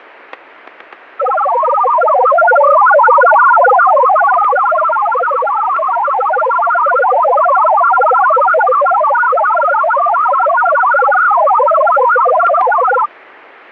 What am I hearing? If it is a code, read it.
Multi-tone FSK (Olivia or MFSK type), about 1000 Hz wide, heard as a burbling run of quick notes, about 62.5 baud, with static crashes.